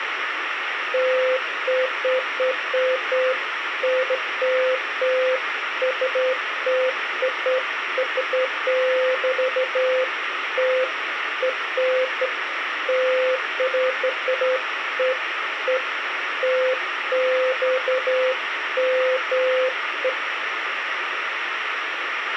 Beeps of irregular length, with radio hiss and a squelch burst at the end. There is no code.